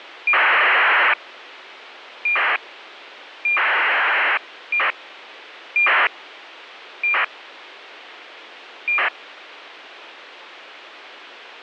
ACARS aircraft data, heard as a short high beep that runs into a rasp, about 2400 baud, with radio hiss.